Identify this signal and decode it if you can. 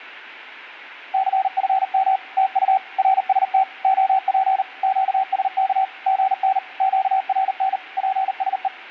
Morse code, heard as a keyed tone, machine-sent, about 39 wpm, 770 Hz. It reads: CFM TU RST OP QSK GN QRN PSE